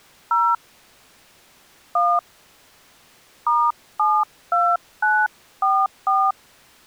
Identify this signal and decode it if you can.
DTMF, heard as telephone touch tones, dialled by hand, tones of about 240 ms. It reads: 0 1 *72944